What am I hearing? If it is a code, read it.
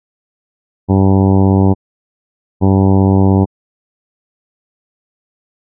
Ship horn signal, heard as a ship's horn, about 100 Hz. 2 short. At sea: I am altering course to port.